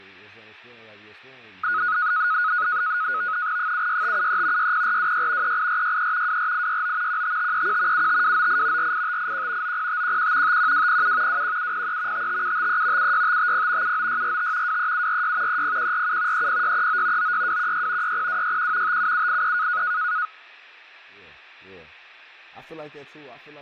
NAVTEX (SITOR-B), 100 baud, 170 Hz shift, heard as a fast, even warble, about 1360 Hz centre, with fading and speech in English. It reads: 76573 60426 38463 24869 15531 75298 48581 90511 51207 21703 55753 76550 79645 23746 30147 30639 96216 60261 57783